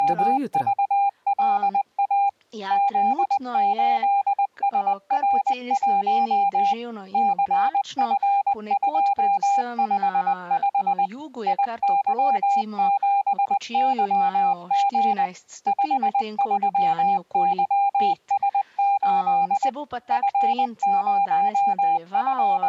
Morse code, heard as a keyed tone, machine-sent, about 20 wpm, 800 Hz. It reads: … Z8SR1 CF255 IY7YG 53YS8 …